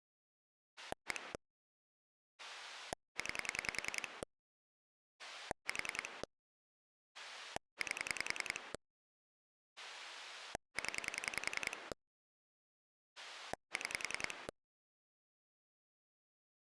Pulse dialling, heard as a rotary dial, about 10 pulses a second. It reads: 1 9 4 8 0 6